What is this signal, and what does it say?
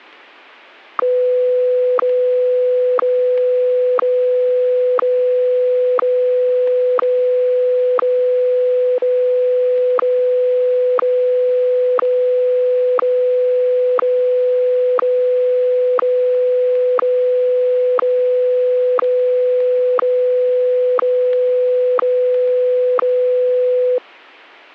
Radio time signal (WWVH, Hawaii), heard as ticks, one a second, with static crashes.